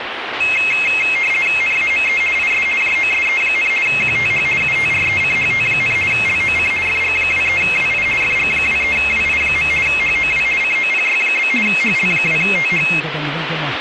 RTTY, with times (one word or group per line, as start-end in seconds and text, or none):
1.6-2.2 NAME
2.4-2.7 IS
2.8-3.7 JOSE,
3.9-4.5 QTH
4.6-6.0 UTRECHT,
6.1-6.7 LOC
6.9-8.1 FG23WI
8.2-9.7 FG23WI.
9.9-10.5 HOW
10.6-11.5 COPY?
11.7-12.9 HL2TH